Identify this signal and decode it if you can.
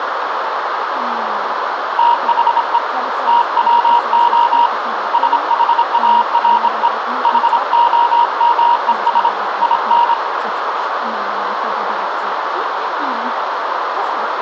Morse code, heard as a keyed tone, hand-sent with a bug key, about 26 wpm, 950 Hz, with radio static and a narrow filter. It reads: THE TWO SHARE HOMES IN